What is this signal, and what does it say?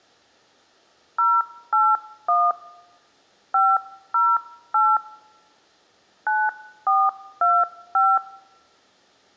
DTMF, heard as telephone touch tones, dialled by hand, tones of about 230 ms. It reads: 081 508 9425